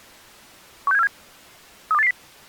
Five-tone selective call (EEA), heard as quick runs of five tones, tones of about 40 ms. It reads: 16747 32880